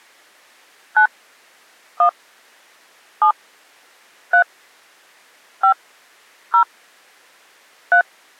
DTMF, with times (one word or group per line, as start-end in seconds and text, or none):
1.0-1.1 9
2.0-2.1 1
3.2-3.3 7
4.3-4.4 3
5.6-5.7 5
6.5-6.6 0
7.9-8.0 3